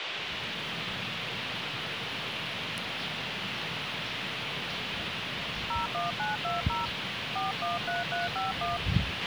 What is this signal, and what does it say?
DTMF, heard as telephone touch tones, dialled by hand, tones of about 160 ms, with radio hiss, a squelch burst at the end and the noise of a park. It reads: 01920 413351